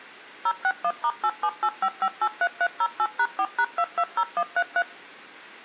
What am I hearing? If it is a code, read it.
DTMF, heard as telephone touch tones, dialled by machine, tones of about 60 ms. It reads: 061*8785583308#4#220133